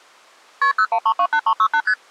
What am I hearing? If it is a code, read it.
Multi-frequency trunk signalling (R1, as on North American trunks), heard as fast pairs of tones, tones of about 70 ms. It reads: KP 01328368 ST